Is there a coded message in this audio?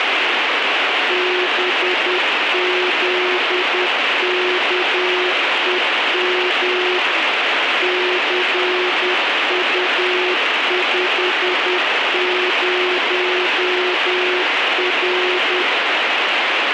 Yes: Morse code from 1.0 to 15.7 s, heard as a keyed tone, machine-sent, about 10 wpm, 360 Hz, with heavy radio static. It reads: BZKEM CU50R